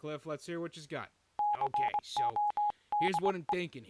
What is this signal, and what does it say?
Morse code, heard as a keyed tone, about 21 wpm, 830 Hz, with speech in English. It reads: CODE